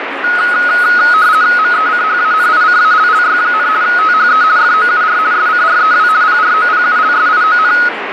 RTTY (50 baud, 170 Hz shift), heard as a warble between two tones, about 1360 Hz centre, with radio static and speech in Maithili. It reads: MECHANICALLY, THE FOUR SCREW PROPULSION